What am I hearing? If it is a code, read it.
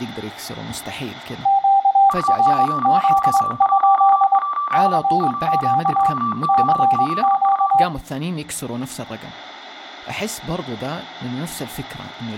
Morse code, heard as two keyed tones, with room echo and speech in Arabic. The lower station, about 22 wpm, 790 Hz: QRZ? CQ CQ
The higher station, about 35 wpm, 1160 Hz: UP211 23OZU